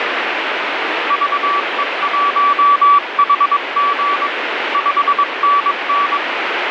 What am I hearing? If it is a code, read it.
Morse code, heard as a keyed tone, hand-sent with a paddle, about 22 wpm, 1150 Hz, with radio static. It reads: VE1HG 5NN